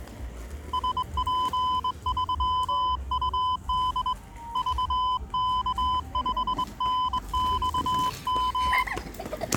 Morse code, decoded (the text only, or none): SP3UD VK5NXM